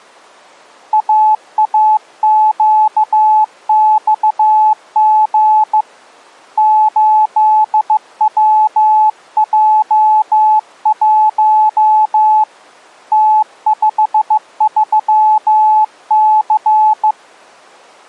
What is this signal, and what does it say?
Morse code, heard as a keyed tone, hand-sent with a bug key, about 15 wpm, 860 Hz. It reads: AAQXG 8WJ1 T53C